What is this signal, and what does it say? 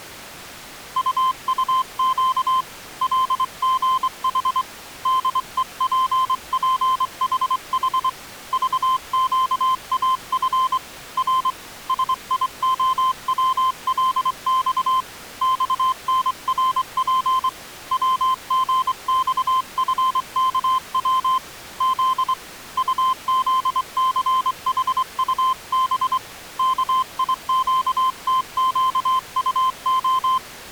Morse code, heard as a keyed tone, hand-sent with a straight key, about 24 wpm, 1040 Hz. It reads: UUQ LGH DEPPHH VQAF R SIOWLX XNRP WGXFKW Z UZCHUB KIQTQUO